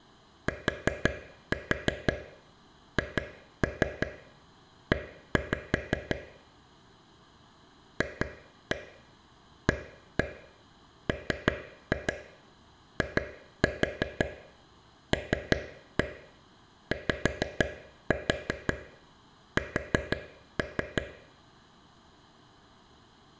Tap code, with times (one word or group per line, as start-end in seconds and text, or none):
0.5-6.2 THE
8.0-21.0 FAMILYS